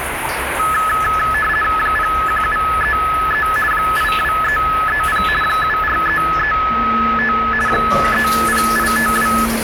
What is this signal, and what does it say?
RTTY (50 baud, 450 Hz shift), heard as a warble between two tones, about 1500 Hz centre, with radio static and the noise of a restroom. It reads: 01733 82330 74335 30852